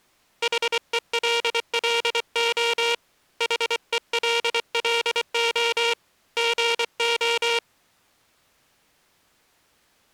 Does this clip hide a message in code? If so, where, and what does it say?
Yes: Morse code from 0.4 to 7.6 s, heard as a buzzer, hand-sent with a paddle, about 24 wpm. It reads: HELLO HELLO GO